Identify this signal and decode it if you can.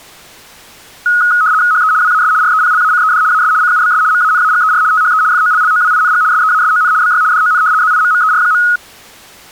RTTY (75 baud, 170 Hz shift), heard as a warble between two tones, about 1360 Hz centre. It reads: HE WAS REPLACED AS CUBS MANAGER THE FOLLOWING SEASON BY DON ZIMMER.